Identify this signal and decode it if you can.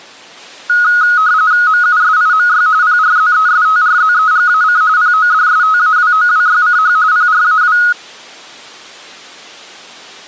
RTTY (45.45 baud, 170 Hz shift), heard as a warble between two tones, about 1360 Hz centre. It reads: MUSIMY PRZESTRZEGAC PODSTAWOWYCH PRAW